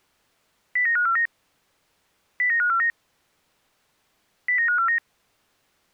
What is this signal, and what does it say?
Five-tone selective call (CCIR), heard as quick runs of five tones, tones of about 100 ms. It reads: 09549 09549 09549